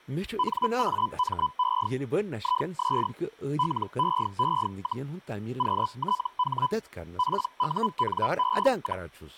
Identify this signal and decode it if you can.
Hellschreiber (Feld-Hell, 122.5 baud), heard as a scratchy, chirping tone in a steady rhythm, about 1000 Hz, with speech in Kashmiri. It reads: NAME IS LEE, QTH PUNE,